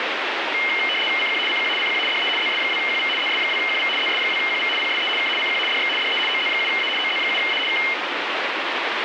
RTTY (75 baud, 850 Hz shift), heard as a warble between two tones, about 2550 Hz centre, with radio static. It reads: CQ CQ CQ DE ZS2QV ZS2QV ZS2QV PSE K CQ DX DE OZ7A OZ7A K